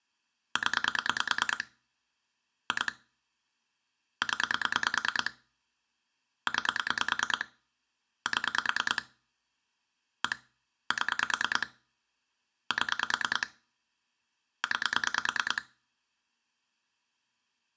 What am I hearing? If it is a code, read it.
Pulse dialling, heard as clicks on a phone line, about 9 pulses a second, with room echo. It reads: 0 2 0 9 7 1 7 7 9